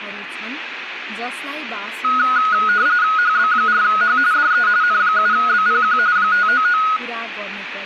RTTY (45.45 baud, 170 Hz shift), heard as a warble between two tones, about 1360 Hz centre, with radio static and speech in Nepali. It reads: HB4H DE N7BPQ 599